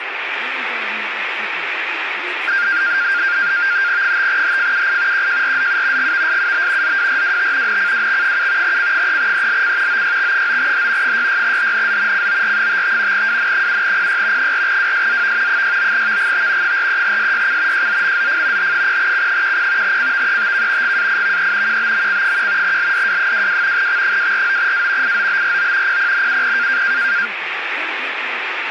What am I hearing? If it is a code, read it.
NAVTEX (SITOR-B), 100 baud, 170 Hz shift, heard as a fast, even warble, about 1500 Hz centre, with radio static and speech in English. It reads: 5HFUI QJRZU GVSUB ZWRWT NCWX7 C3ELC OYX9H 66HNZ COR55 WN7PY 4WSZV 69VGT 43SYC JZMZF H0C10 CVETK GAIVE QBMC1 LDW22 X249A IOBRO PPNUP